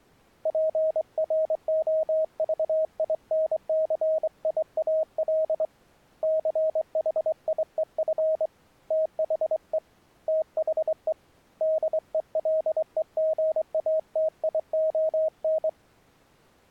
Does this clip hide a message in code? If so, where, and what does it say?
Yes: Morse code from 0.4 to 15.8 s, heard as a keyed tone, hand-sent with a straight key, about 23 wpm, 630 Hz. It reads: PROVINCIAL CHIEF THE THE DELEGATION